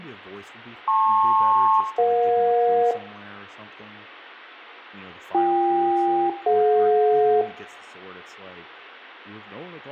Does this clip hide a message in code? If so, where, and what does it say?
Yes: aircraft SELCAL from 0.9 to 7.4 s, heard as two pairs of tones, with room echo and speech in English. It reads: LP-EJ BK-DJ